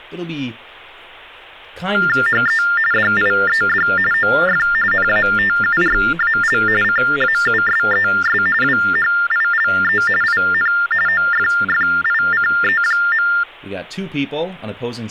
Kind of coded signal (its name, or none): TTY/TDD text telephone tones